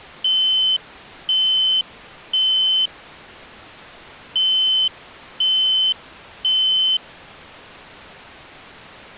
Alarm pattern, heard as an alarm's beeps, played twice, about 3050 Hz. Temporal three. Smoke or fire, evacuate.